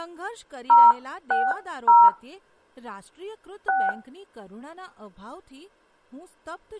DTMF, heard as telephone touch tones, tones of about 210 ms, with speech in Gujarati. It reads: 060 6